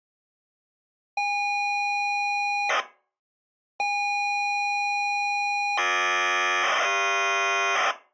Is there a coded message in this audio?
Yes: ZX Spectrum tape loading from 1.2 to 7.9 s, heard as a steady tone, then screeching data.